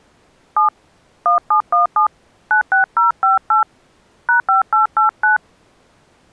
DTMF, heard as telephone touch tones, dialled by hand, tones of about 130 ms. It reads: 7 1717 96058 #5889